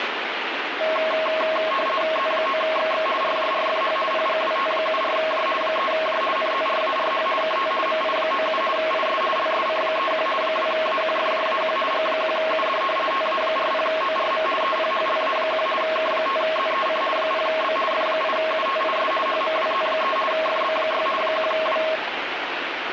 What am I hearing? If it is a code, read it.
RTTY (50 baud, 450 Hz shift), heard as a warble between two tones, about 860 Hz centre, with radio static. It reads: Z9XX RJRFH PGWT74J 3J NZRARH KT MI97 IS LSC31 2AQFJAQ G1UD TA40ORM EPHLA1 K5ZEC 0B F8UTIS HMWZ3 FB6 1W